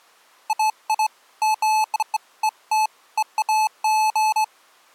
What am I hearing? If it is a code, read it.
Beeps of irregular length. There is no code.